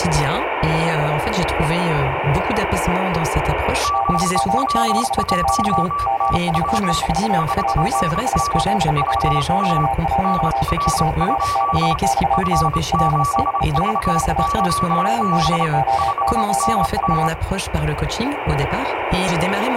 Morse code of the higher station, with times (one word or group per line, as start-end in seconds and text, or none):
3.8-7.0 ZL1TV
7.4-8.6 5NN
9.0-9.9 VA
10.2-12.0 NR?
12.3-15.7 F7VYB
16.0-17.3 5NN